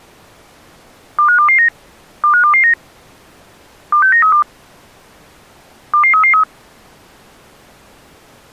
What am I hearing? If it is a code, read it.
Five-tone selective call (CCIR), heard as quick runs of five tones, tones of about 100 ms. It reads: 25229 25229 26932 22333